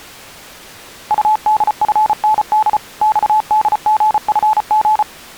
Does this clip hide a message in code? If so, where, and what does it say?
Yes: Morse code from 1.0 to 5.1 s, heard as a keyed tone, machine-sent, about 34 wpm, 870 Hz. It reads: UDFND XDGFG